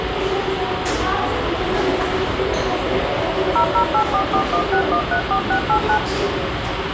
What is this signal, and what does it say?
DTMF, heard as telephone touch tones, dialled by machine, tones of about 90 ms, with radio hiss, room echo and the noise inside a lift. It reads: 0084416134689